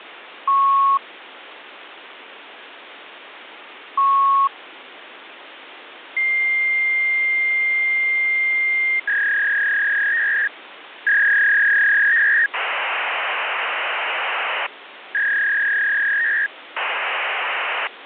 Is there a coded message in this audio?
Yes: fax machine handshake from 0.5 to 17.9 s, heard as beeps, a long tone, a warble and hiss, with phone line noise.